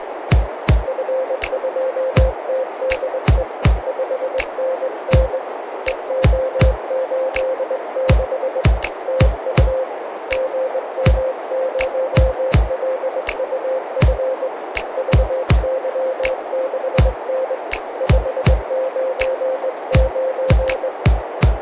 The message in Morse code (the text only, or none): F2TDE 5NN EO86 TU GM0LUF VY6N 599